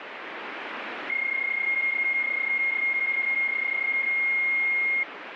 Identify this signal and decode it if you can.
PSK31 (31.25 baud), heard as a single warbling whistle, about 2150 Hz, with radio static.